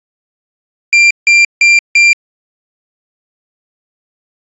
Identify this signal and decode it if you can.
Beep code, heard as a piezo beeper, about 2400 Hz. 4 short. In AMI BIOS tables: system timer failure; in Dell tables: memory read or write failure.